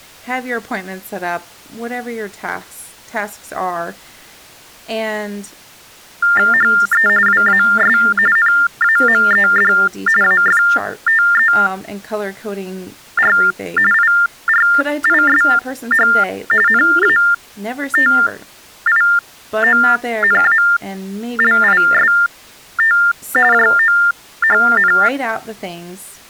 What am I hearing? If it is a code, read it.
TTY/TDD text telephone tones (45.45 baud Baudot), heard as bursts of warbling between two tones, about 400 Hz shift, 1600 Hz centre, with speech in English. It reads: HE WAS NAMED AFTER IRISH NATIONALIST JOHN